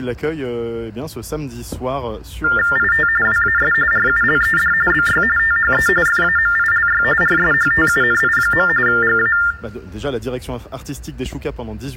TTY/TDD text telephone tones (45.45 baud Baudot), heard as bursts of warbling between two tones, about 400 Hz shift, 1600 Hz centre. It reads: IT WAS RULED BY THE FAMILY RSHTUNI. GA